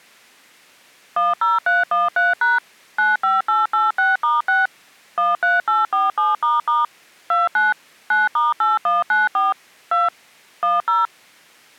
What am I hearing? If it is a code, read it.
DTMF, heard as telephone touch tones, dialled by machine, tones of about 170 ms. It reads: 10313# 95886*6 13847** 29 9*8194 2 10